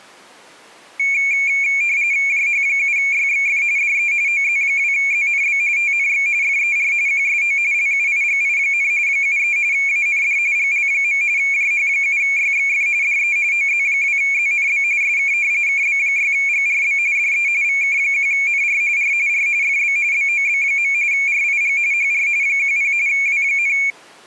RTTY (45.45 baud, 170 Hz shift), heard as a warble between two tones, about 2300 Hz centre. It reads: JH7YXF DE OZ2ZNB TNX FER QSO LUIGI, 73 AND GL. JH7YXF DE OZ2ZNB SK KB6GRB DE VK1NR R R FB BOB. RIG HR 10 W,